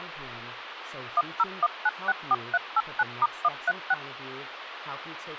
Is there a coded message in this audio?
Yes: DTMF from 1.2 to 3.9 s, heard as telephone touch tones, dialled by machine, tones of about 40 ms, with phone line noise and speech in English. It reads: 101964389*136